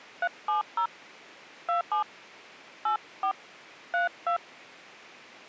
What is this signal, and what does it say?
DTMF, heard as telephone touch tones, dialled by hand, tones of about 100 ms. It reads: 370 27 84 32